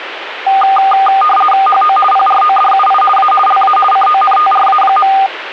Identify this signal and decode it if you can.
RTTY (50 baud, 450 Hz shift), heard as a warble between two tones, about 1000 Hz centre, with radio static. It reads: HO PRODUI A LA CONTRA.